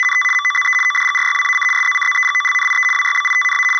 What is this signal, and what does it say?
RTTY (75 baud, 850 Hz shift), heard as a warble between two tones, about 1600 Hz centre. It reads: … MOZE ODGRYWAC SZCZEGOLNIE WYBITNA …